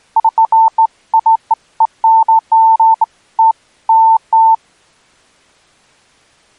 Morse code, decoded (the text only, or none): none